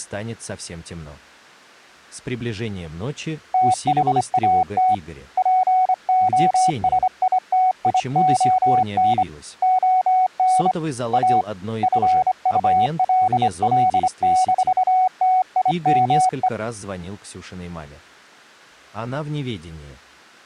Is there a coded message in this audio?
Yes: Morse code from 3.5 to 16.5 s, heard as a keyed tone, hand-sent with a straight key, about 25 wpm, 740 Hz. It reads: THAT POSITION ON A FULL-TIME